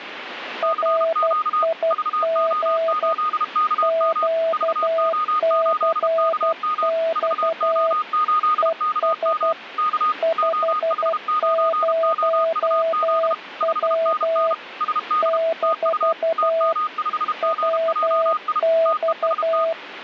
Morse code, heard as two keyed tones, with radio static. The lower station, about 12 wpm, 660 Hz: RIG QCX ES 50W - WX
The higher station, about 32 wpm, 1240 Hz: CQ VO8KM VO8KM VO8KM K OH9OUZ 5NN SD TU TM5GJI TEST